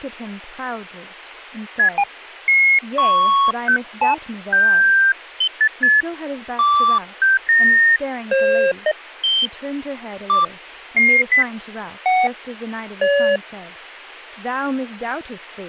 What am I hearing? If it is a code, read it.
Electronic bleeps of random pitch and length, with speech in English. There is no code.